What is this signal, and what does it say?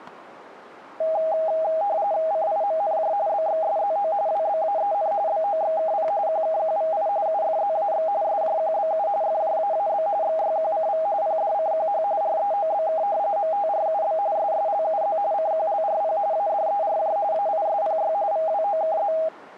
RTTY (45.45 baud, 170 Hz shift), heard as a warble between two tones, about 720 Hz centre, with static crashes. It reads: CIMNJ BXSZO WBAEN BOXKP QKQVI UFZAX SJQBU FJAAB XYQCV PDCQH REOBK MTRUB SSLUZ CQLRP ADERJ AISPY VWOKZ